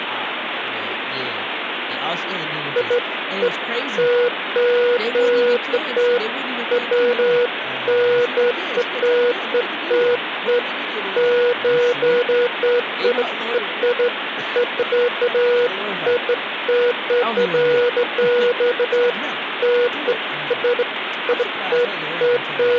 Beeps of irregular length, with phone line noise and speech in English. There is no code.